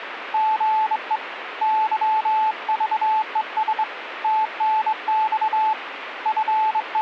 Morse code, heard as a keyed tone, hand-sent with a straight key, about 23 wpm, 870 Hz, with radio static. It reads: GE YVES TNX …